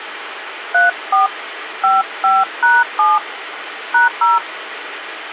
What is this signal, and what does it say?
DTMF, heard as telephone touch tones, dialled by hand, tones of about 170 ms, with phone line noise. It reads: 34 55#7 #0